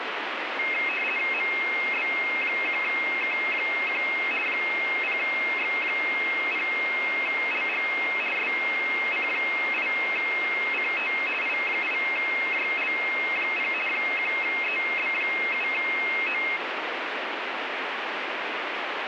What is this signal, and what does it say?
RTTY (50 baud, 450 Hz shift), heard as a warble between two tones, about 2350 Hz centre, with radio static. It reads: MB1K1 0X0LG SC8CT I8JL0 1EB7O